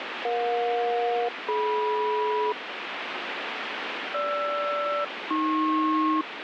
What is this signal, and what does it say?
Aircraft SELCAL, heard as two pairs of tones, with radio static. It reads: EJ-DM GR-AP